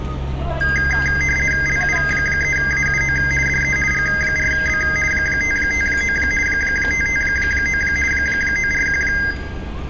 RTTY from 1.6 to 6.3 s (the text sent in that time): LU3AUO DE G4B 559